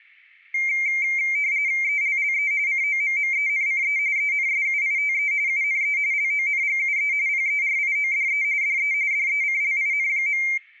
RTTY (45.45 baud, 170 Hz shift), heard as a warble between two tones, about 2200 Hz centre. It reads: ELLE COMMENCE ENSUITE UNE LONGUE PERIODE DE DECLIN.